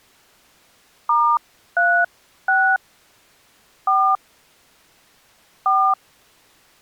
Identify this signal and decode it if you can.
DTMF, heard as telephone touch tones, dialled by hand, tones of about 280 ms. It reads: *36 4 4